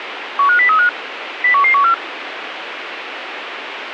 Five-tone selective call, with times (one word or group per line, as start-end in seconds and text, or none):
0.4-0.9 15035
1.4-1.9 01114